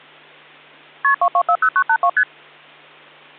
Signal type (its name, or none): multi-frequency trunk signalling